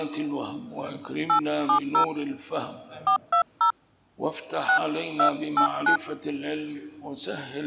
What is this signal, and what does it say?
DTMF, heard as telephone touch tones, dialled by hand, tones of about 100 ms. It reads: 870 420 6289